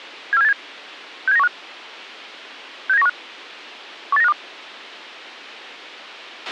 Five-tone selective call (EEA), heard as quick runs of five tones, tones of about 40 ms, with a squelch burst at the end. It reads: 74787 67915 67915 18952